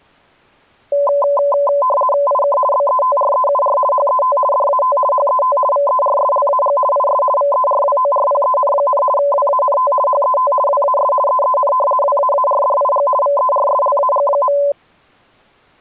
RTTY (50 baud, 450 Hz shift), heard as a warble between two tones, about 800 Hz centre. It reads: IK BETREUR HET DAT HET VERSLAG IS VERWORPEN, WANT HET WAS EEN WAARDIG VERSLAG.